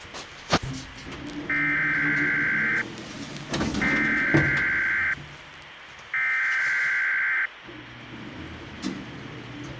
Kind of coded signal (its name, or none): Emergency Alert System (SAME) tones